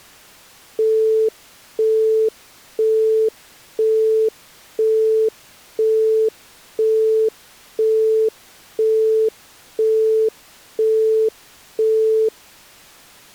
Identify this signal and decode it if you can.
Telephone call progress tone (single-tone plan, as in Europe, Japan and elsewhere), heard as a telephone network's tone, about 440 Hz, 0.5 s on and 0.5 s off. Busy tone.